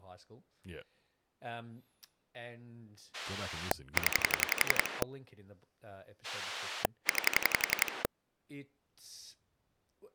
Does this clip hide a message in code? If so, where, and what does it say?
Yes: pulse dialling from 3.1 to 8.1 s, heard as a rotary dial, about 11 pulses a second, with speech in English. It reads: 0 9